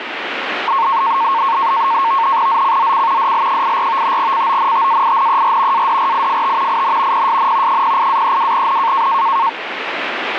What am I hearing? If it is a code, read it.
NAVTEX (SITOR-B), 100 baud, 170 Hz shift, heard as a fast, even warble, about 1000 Hz centre, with radio static. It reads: ZCZC DL84 CONTAINER ADRIFT IN PSN 08-32N